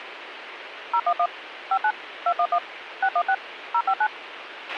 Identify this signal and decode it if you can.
DTMF, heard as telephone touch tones, dialled by machine, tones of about 70 ms, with radio hiss and a squelch burst at the end. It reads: 011 59 211 616 059